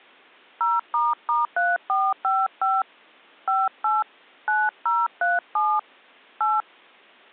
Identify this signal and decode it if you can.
DTMF, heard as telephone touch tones, dialled by hand, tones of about 210 ms. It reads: 0**3455 58 9037 8